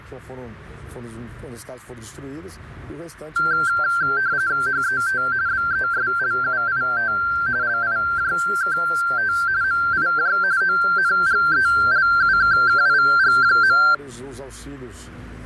RTTY (45.45 baud, 170 Hz shift), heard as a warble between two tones, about 1470 Hz centre, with fading. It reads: HET BESLUIT LIJKT MIJ ONGELUKKIG.